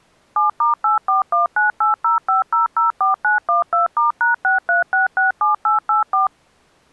DTMF, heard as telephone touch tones, dialled by machine, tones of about 140 ms. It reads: 7*8419805004912*#63667884